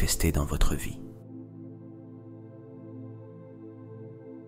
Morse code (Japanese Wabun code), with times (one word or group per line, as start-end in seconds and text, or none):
none